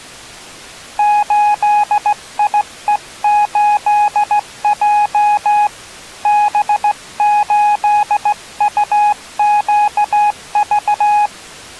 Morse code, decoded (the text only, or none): 8IE8J B8UQV